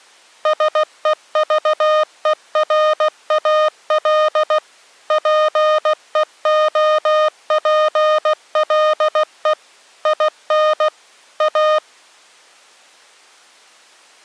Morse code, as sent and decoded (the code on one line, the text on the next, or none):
... . ...- . .-. .- .-.. / .--. . --- .--. .-.. . / .. -. / .-
SEVERAL PEOPLE IN A